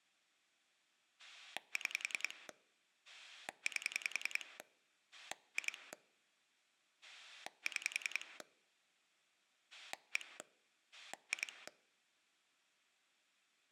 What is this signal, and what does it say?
Pulse dialling, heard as a rotary dial, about 10 pulses a second. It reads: 6 8 2 6 1 2